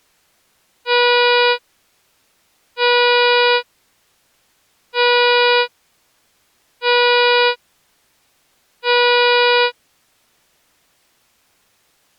Ship horn signal, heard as a ship's horn, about 490 Hz. 5 short. At sea: I doubt that you are doing enough to avoid a collision.